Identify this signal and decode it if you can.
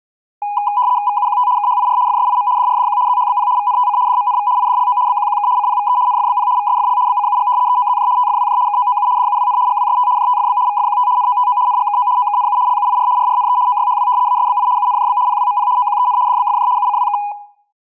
RTTY (75 baud, 170 Hz shift), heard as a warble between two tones, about 910 Hz centre. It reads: VUQT KHIR FSIM DRDQ ZHBP VNTC DMNV IDLO BQQK CPVE NFBP VSFL BCUG EOZJ TFWJ KOOU DUWN GWST JTFB VFQT NOTO NGKO OKNU LUIR RRNE OYHW ASBI UNJB PWMP OQEN DBFJ UCWK